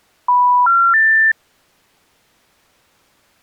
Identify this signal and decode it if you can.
Telephone call progress tone (North American plan), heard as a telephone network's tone, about 980, 1370, 1800 Hz. Special information tone.